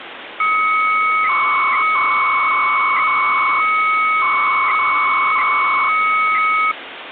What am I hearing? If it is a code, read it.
300-baud modem data (Bell 103 tones), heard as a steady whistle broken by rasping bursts, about 300 baud, 200 Hz shift, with phone line noise.